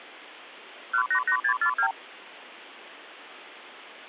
Multi-frequency trunk signalling (R2, with the far end's replies), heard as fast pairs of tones, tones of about 80 ms. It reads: 188642